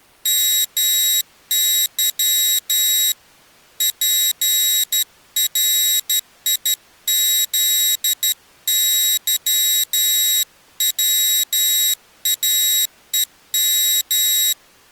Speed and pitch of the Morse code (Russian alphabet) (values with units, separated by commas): 12 wpm, 3800 Hz